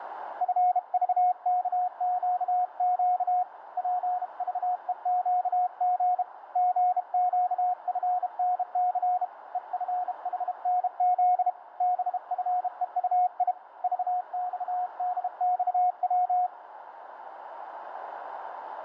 Morse code, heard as a keyed tone, hand-sent with a bug key, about 32 wpm, 720 Hz, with radio static and a narrow filter. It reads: FVKQQ PVEQG GQFNC EFHNZ BFEUI VXDXW